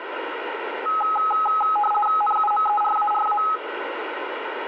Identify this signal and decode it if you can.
RTTY (50 baud, 450 Hz shift), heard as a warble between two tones, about 1060 Hz centre, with radio static and room echo. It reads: NUMERARA